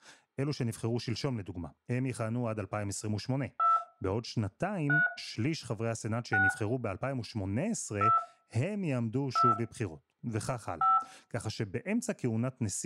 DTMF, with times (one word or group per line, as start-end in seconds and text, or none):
3.6-3.8 2
4.9-5.1 3
6.3-6.5 6
8.0-8.2 2
9.4-9.5 2
10.8-11.0 5